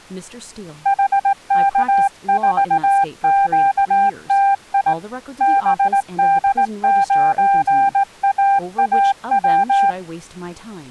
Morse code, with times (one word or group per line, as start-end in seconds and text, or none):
0.9-4.9 HK4QTI
5.4-9.9 BD9AAW